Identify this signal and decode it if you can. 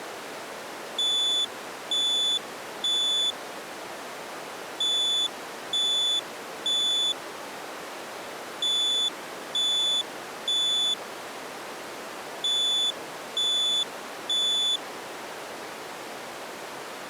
Alarm pattern, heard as an alarm's beeps, played four times, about 3500 Hz. Temporal three. Smoke or fire, evacuate.